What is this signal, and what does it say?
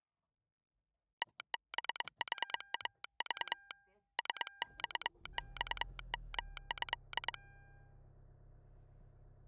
Morse code (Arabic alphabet), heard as a telegraph sounder, hand-sent with a straight key, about 22 wpm, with the noise inside a car. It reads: تبحاض سصصمه